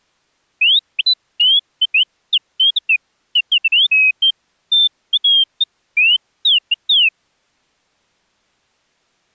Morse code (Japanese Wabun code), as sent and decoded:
none

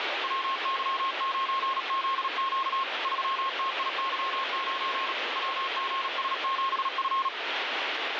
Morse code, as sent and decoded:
.-- -.-- ----. --.. --.- / ...-- - .. -.-- ----. / .-- --. ... --... ..-.
WY9ZQ 3TIY9 WGS7F

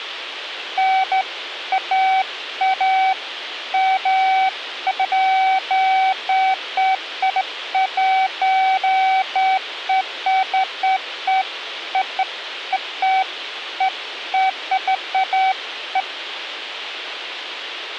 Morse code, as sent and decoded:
none

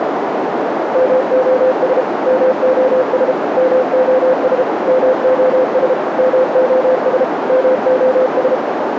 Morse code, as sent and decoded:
-- --- ... / -- --- ... / -- --- ... / -- --- ... / -- --- ... / -- --- ...
MOS MOS MOS MOS MOS MOS

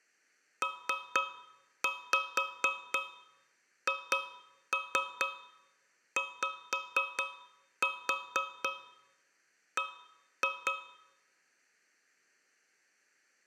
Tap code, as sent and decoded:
3-5 2-3 5-4 1-2
PHYB

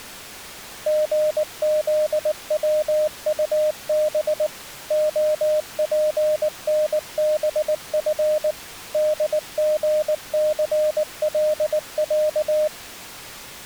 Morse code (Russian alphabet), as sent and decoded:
--. --.. .-- ..- -... / --- .--. -. -... ..-. / -.. --. -.-. .-.. .-.-
ГЗВУБ ОПНБФ ДГЦЛЯ

